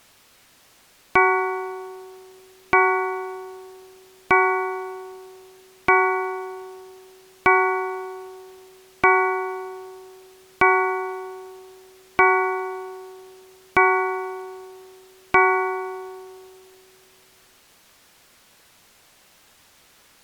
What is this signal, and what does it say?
Clock strike, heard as a bell. 10. Ten o'clock.